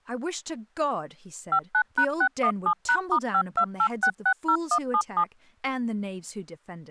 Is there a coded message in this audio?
Yes: DTMF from 1.5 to 5.2 s, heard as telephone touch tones, dialled by machine, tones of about 70 ms, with speech in English. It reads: 59#617#*528660177